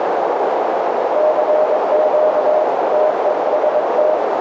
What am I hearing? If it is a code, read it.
Morse code, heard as a keyed tone, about 22 wpm, 620 Hz, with heavy radio static and a narrow filter. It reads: CQ TEST